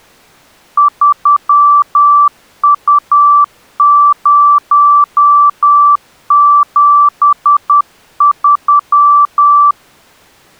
Morse code, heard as a keyed tone, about 10 wpm, 1160 Hz. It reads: 3U073